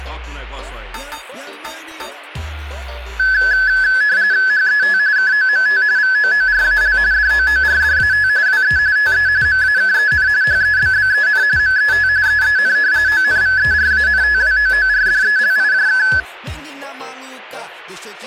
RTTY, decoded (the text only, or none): HET KOMT VOORAL DOORDAT WE TE MAKEN HEBBEN MET EEN ONVERANTWOORDELIJK